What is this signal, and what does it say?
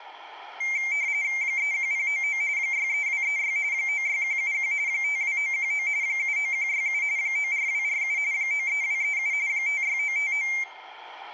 RTTY (45.45 baud, 170 Hz shift), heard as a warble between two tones, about 2200 Hz centre, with room echo. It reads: 31099 63236 96171 52919 79167 94247 93237 56959